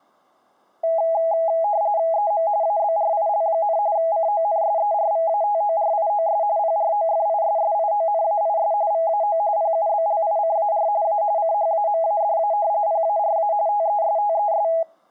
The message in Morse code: none

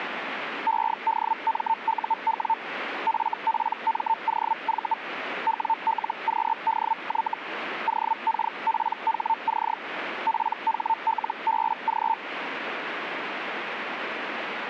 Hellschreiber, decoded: EDMUW FPMOV WLQDY OKPHC PHLBG

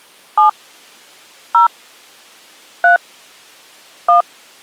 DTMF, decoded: 7 0 3 1

